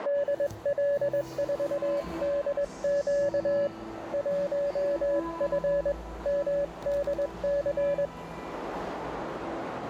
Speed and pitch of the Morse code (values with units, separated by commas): 21 wpm, 570 Hz